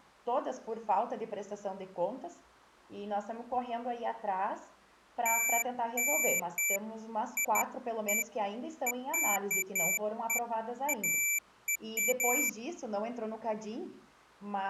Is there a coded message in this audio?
No, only beeps of irregular length.